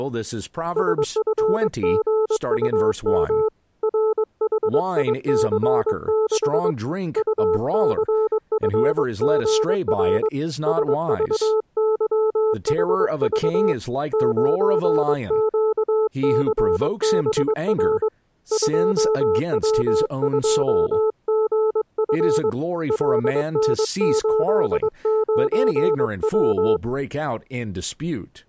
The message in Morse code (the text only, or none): SFGUM RHIC6 UCFGR SVYHV 9QCBR 2W2GF LN89W